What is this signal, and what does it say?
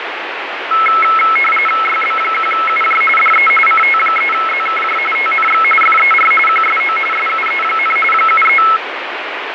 RTTY (45.45 baud, 850 Hz shift), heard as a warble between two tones, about 1750 Hz centre, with radio static. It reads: YB1UJ DE CT3ZKJ TNX FER QSO SUE, 73